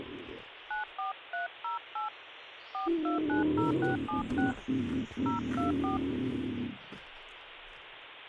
DTMF, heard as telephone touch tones, dialled by hand, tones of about 130 ms, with phone line noise. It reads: 94308 4290676 024